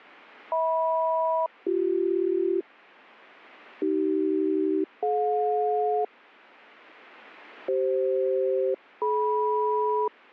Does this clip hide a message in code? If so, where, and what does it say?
Yes: aircraft SELCAL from 0.5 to 10.1 s, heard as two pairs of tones. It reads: HM-BC AC-DJ CF-DM